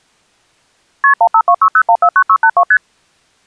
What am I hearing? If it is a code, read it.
Multi-frequency trunk signalling (R1, as on North American trunks), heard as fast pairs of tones, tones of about 70 ms. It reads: KP 15260149682 ST